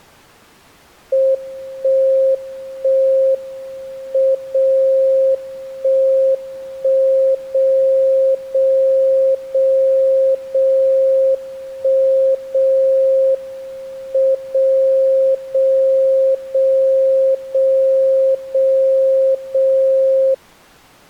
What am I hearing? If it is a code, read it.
Radio time signal (WWVB), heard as a tone whose level steps once a second, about 530 Hz. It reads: 1 1 M 0 1 1 0 0 0 0 1 0 M 0 0 0 0 0 0